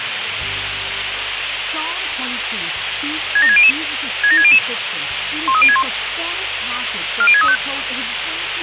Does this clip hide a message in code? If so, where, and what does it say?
Yes: five-tone selective call (ZVEI) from 3.4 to 7.6 s, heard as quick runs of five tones, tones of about 70 ms, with radio hiss. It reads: 67600 67600 13061 40635